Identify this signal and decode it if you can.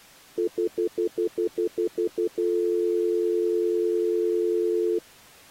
Telephone call progress tone (North American plan), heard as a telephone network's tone, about 350, 440 Hz, 0.1 s on and 0.1 s off. Stutter dial tone.